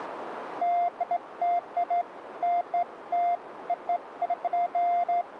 Beeps of irregular length, with radio static. There is no code.